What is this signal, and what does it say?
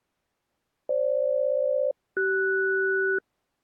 Aircraft SELCAL, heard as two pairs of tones. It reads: FG-CS